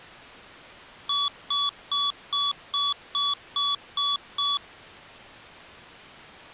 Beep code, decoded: 9 short

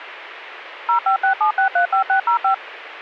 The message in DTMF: 0567635605

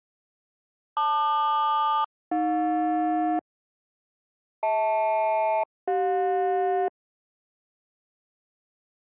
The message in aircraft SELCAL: LQ-AJ HL-CJ

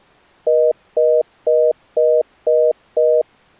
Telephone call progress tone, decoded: congestion tone

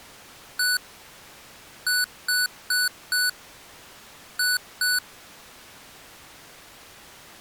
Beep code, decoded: 1-4-2

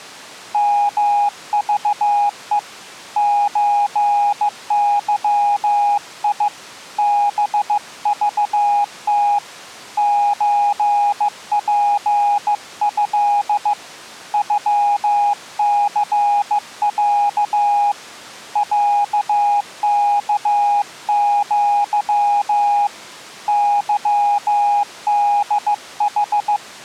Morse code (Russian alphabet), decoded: МЖЕ ЧЫИ БЖТ ЧПЭ ЮЦЯ ЯКЪ ЫДХ

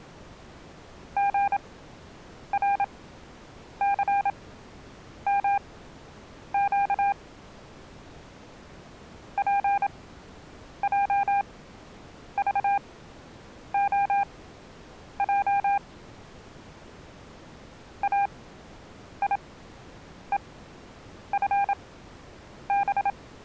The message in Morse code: GRCMQ PJVOJ AIEFB

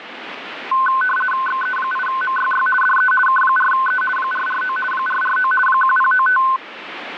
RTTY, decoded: XE8MYY DE K4E 449 449 1095

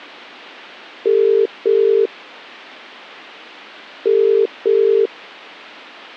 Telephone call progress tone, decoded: ringback tone

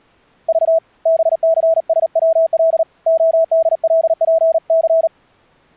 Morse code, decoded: V BCSWL ODLPC

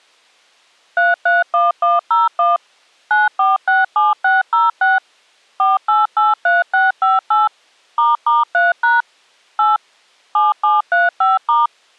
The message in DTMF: 331101 9467606 4883658 **3# 8 7735*

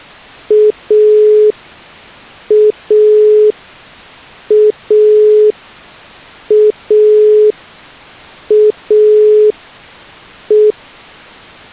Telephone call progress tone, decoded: dial tone

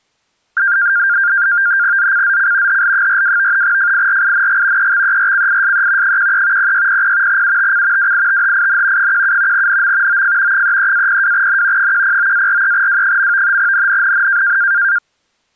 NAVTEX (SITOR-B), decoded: ZCZC HL42 FIRING EXERCISE 13 0600 UTC WITHIN 17 NM OF 33-02N 109-43W. NNNN

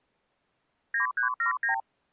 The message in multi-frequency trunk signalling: 9379

